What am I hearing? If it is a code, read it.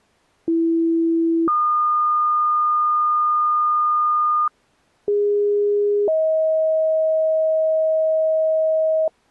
Two-tone page, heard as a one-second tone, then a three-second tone, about 330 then 1220 Hz, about 410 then 630 Hz.